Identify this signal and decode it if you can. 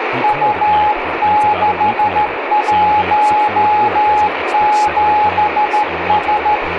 Morse code, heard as a keyed tone, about 13 wpm, 840 Hz, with radio static, room echo and speech in English. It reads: U617S